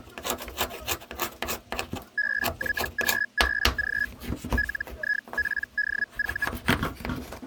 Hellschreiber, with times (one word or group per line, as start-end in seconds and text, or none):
2.2-4.1 BYGBG
4.6-6.5 LIPDV